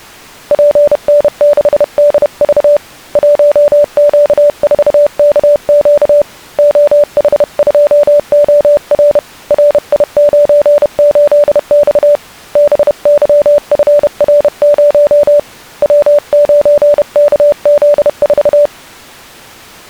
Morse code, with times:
0.5-2.8 PN6DV
3.2-6.2 1Q4KQ
6.6-9.2 OH2OR
9.5-12.2 RI98X
12.6-15.4 BYFR0
15.8-18.7 W9KZ4

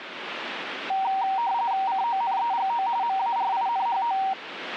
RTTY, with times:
1.9-2.9 CONEGO
3.0-4.2 MARINHO

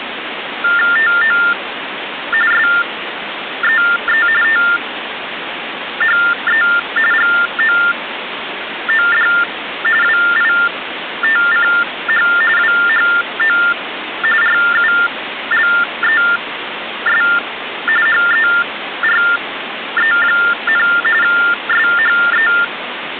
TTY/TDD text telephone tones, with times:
1.0-1.4 TO
2.5-4.3 SEE
4.4-6.6 THE
7.1-9.3 GOOD
10.0-12.3 WITCH
12.6-13.6 WHO
14.4-17.2 RULES
18.1-20.9 HERE,
21.2-22.5 SHE

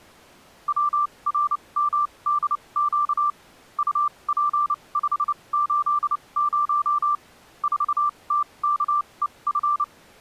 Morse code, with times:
0.7-3.3 WRMDQ
3.8-7.1 UP580
7.6-9.8 4TKEF

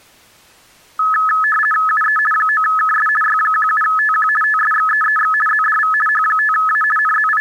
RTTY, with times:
1.9-2.2 UE
2.3-3.1 9KS
3.2-4.3 Y17TQ
4.4-5.3 TSXEEX
5.5-5.9 ZDV
6.1-6.8 H5A
7.0-7.4 …

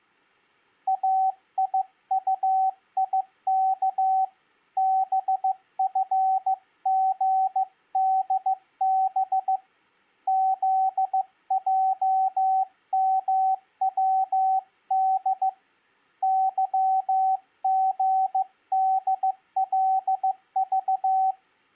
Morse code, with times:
0.9-4.2 AIUIK
4.8-9.6 BFGDB
10.3-15.5 ZJMWD
16.2-21.3 YGDLV

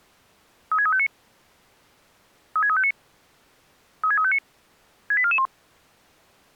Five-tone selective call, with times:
0.7-1.1 36359
2.6-2.9 36359
4.0-4.4 36359
5.1-5.5 68441

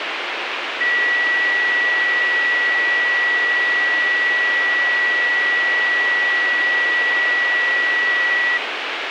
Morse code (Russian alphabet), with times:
none

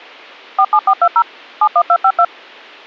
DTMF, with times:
0.6-1.2 47420
1.6-2.2 71252

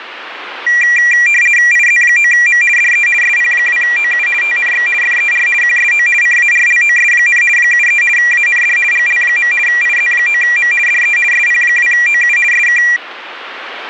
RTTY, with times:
1.7-2.6 IZ9M
2.8-3.1 DE
3.2-4.3 SP2OU
4.4-4.9 TNX
5.0-5.5 FER
5.6-6.1 QSO
6.2-7.4 CARLOS,
7.6-8.0 73
8.2-8.8 AND
8.9-9.5 GL.
9.7-10.7 IZ9M
10.9-11.2 DE
11.3-12.4 SP2OU
12.5-12.8 SK

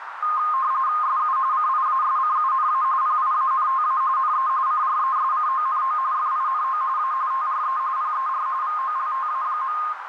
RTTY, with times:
1.0-1.4 SU
1.5-2.8 CIASCUNA
3.0-4.0 PIANTA
4.2-4.5 NE
4.7-6.0 CRESCONO
6.1-6.8 FINO
7.0-7.1 A
7.3-7.8 TRE
8.0-8.5 PER
8.6-9.8 VOLTA.

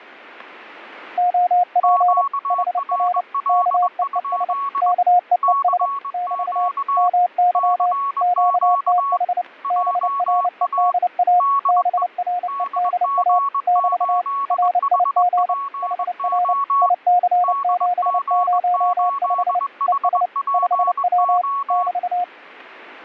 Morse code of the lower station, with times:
1.2-2.2 OP
2.5-3.2 HR
3.5-4.5 KEES
4.8-5.9 KEES
6.1-6.7 <BT>
7.0-7.9 MY
8.2-9.4 QTH
9.7-11.4 BREDA
11.7-13.4 BREDA
13.7-14.2 <BT>
14.5-15.5 RIG
15.8-16.5 HR
16.8-19.6 IC705
19.9-20.3 ES
20.5-21.4 5W
21.7-22.2 <BT>

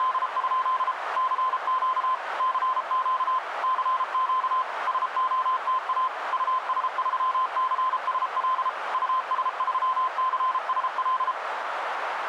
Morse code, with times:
0.0-0.9 …
1.2-2.1 CQ
2.4-3.4 CQ
3.6-4.6 CQ
4.9-6.1 SOTA
6.3-8.7 US3CSL
8.9-11.3 US3CSL

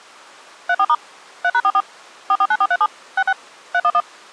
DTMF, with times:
0.7-0.9 34*
1.4-1.8 3#44
2.3-2.9 449437
3.2-3.3 66
3.7-4.0 311

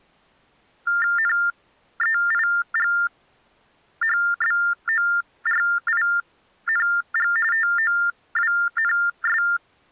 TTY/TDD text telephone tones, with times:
1.2-7.3 NEIGHBORING
7.5-9.4 TOWNS

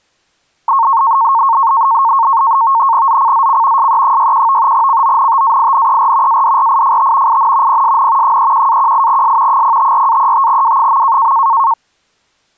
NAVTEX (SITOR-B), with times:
3.1-3.9 ZCZC
3.8-4.7 SE61
4.7-6.4 CONTAINER
6.3-7.4 ADRIFT
7.3-7.8 IN
7.7-8.4 PSN
8.2-9.6 31-18S
9.5-11.3 054-35W.

